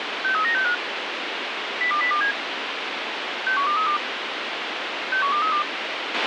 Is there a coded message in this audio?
Yes: five-tone selective call (CCIR) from 0.2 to 5.6 s, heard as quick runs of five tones, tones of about 100 ms, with radio hiss and a squelch burst at the end. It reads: 63965 02027 61232 61232